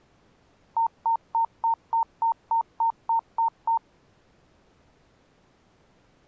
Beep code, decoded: 11 short

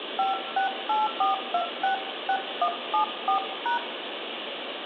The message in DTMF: 5684266174#

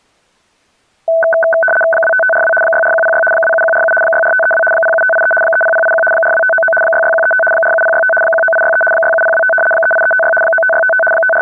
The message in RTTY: 25542 64106 27147 64532 07583 30081 42599 66135 47065 19863 67025 38356 95655 …

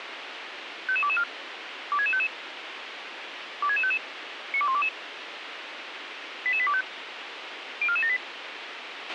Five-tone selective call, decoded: 55224 26655 26655 92122 88825 04478

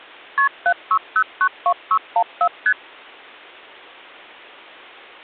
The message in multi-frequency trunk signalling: KP 76092614 ST

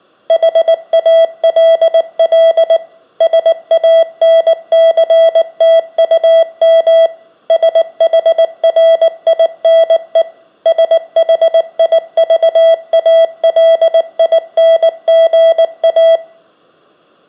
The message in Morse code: HALL SANCTUM SHRINE SHIVALINGA

